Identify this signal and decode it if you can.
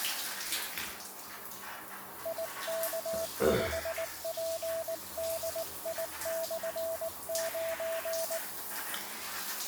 Morse code, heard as a keyed tone, hand-sent with a paddle, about 19 wpm, 660 Hz, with the noise of a restroom. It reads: IK5PDI/9